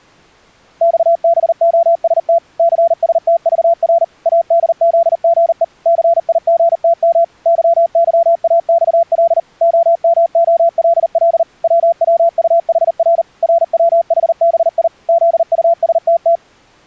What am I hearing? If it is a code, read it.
Morse code, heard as a keyed tone, machine-sent, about 39 wpm, 680 Hz. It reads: XBOST CSTVR ADZGE CIGTM YYAXL OMOLL WWUHR RWHBI ZUSTT